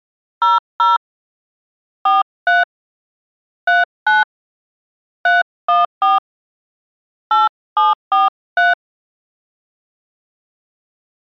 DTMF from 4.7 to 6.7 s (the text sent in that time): 314